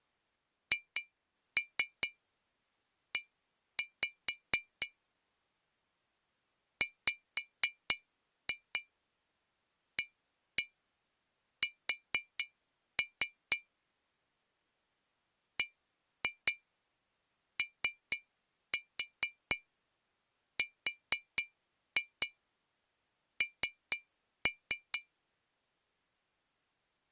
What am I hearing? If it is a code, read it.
Tap code, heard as taps on glass, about 4 knocks a second. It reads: HE WAS BORN